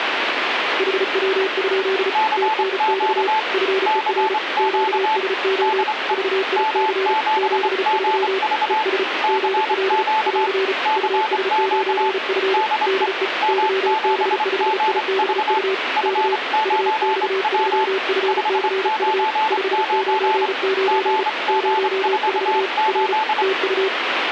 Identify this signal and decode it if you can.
Morse code, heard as two keyed tones, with radio static. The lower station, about 35 wpm, 380 Hz: HW? TNX FER QSO VIC 73 ES GL <AR> US9F DE YB5IBU K UX3FCU 599 04 R TU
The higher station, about 25 wpm, 870 Hz: CQ CQ DE M7GV CQ CQ DE M7GV F9W 599 GG48